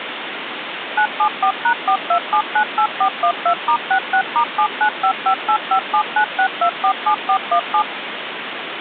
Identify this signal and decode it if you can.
DTMF, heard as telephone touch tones, dialled by machine, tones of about 80 ms, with phone line noise. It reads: 974#42798412*66*795585796247417